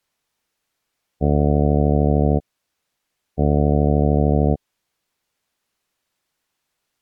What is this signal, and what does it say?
Ship horn signal, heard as a ship's horn, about 70 Hz. 2 short. At sea: I am altering course to port.